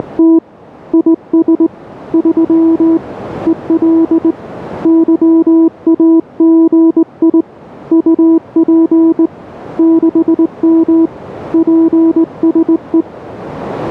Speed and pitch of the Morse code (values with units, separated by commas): 20 wpm, 330 Hz